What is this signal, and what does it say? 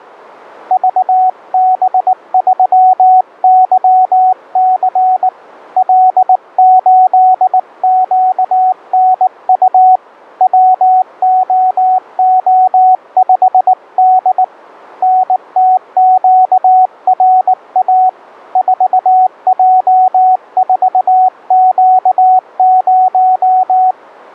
Morse code, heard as a keyed tone, hand-sent with a paddle, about 19 wpm, 740 Hz. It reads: VB3YC L8QNU WOO5D NTQRA 4J4Q0